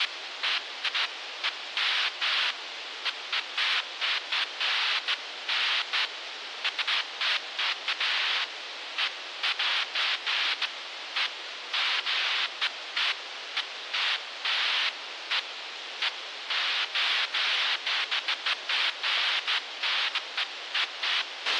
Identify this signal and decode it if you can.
Bursts of noise, with radio hiss and a squelch burst at the end. There is no code.